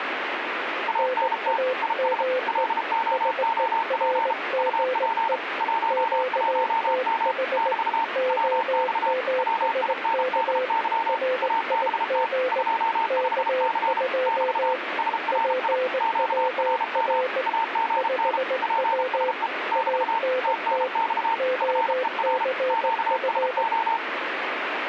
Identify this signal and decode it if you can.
Morse code, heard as two keyed tones, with radio static. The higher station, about 33 wpm, 910 Hz: ANT IS LOOP UP 11M <BT> WX WINDY ABT 25C <BT> SRI QRM AGN PSE <BT> TNX FER QSO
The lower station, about 19 wpm, 510 Hz: NAME SERGE QTH OMSK RIG K2 PWR 5W ANT OCF